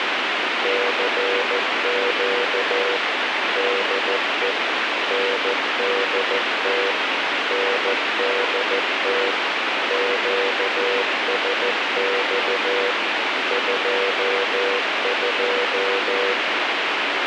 Morse code, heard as a keyed tone, machine-sent, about 14 wpm, 490 Hz, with radio hiss. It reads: CQ DE NDT NDT QSX 22